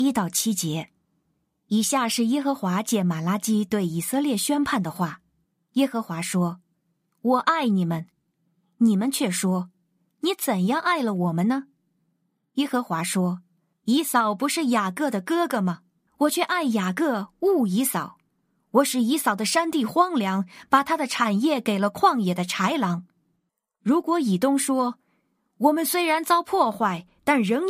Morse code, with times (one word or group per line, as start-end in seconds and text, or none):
none